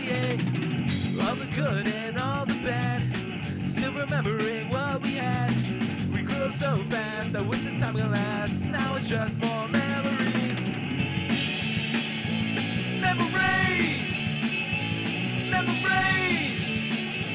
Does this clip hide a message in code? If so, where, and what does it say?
No.